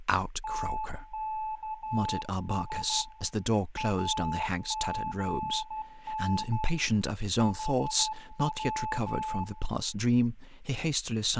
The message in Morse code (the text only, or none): TKS AGN HW